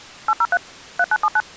DTMF, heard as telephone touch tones, dialled by machine, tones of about 50 ms. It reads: 803 3979